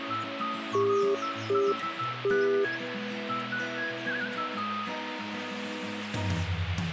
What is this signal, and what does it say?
Telephone call progress tone (UK plan), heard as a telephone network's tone, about 400 Hz, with hum. Congestion tone.